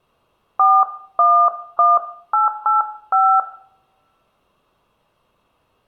DTMF, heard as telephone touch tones, dialled by hand, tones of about 210 ms, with room echo. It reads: 411885